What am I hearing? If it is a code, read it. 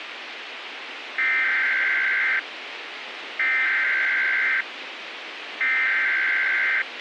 Emergency Alert System (SAME) tones (header bursts), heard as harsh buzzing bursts, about 520.83 baud, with radio hiss and a squelch burst at the end.